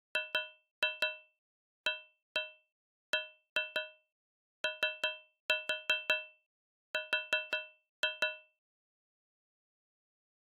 Tap code, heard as taps on a metal pipe, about 5 knocks a second. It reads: GABOR